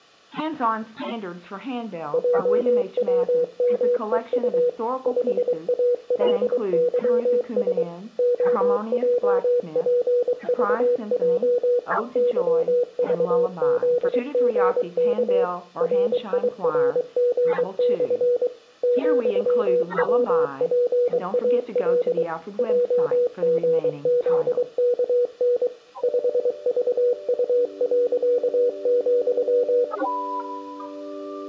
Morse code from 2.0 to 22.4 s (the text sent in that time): JWMEU 5ALYS OJPVJ YVZGK RIRG/ ,WPAL